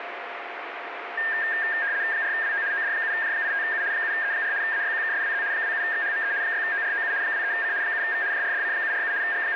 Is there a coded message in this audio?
Yes: RTTY (75 baud, 170 Hz shift) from 1.2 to 9.6 s, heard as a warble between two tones, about 1700 Hz centre, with radio static and a steady whistle near 700 Hz. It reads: 4WO OD7J85U 7E4 AYQKSWZ 27XHME 6OROU 23C 7V JRDC747 …